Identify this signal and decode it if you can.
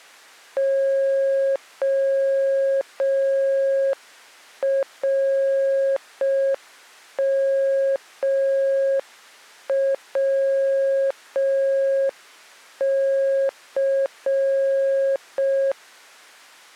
Morse code, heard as a keyed tone, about 5 wpm, 540 Hz. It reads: ORMWC